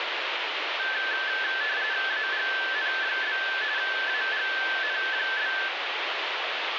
RTTY (45.45 baud, 170 Hz shift), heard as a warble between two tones, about 1650 Hz centre, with radio static. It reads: AGN? AGN?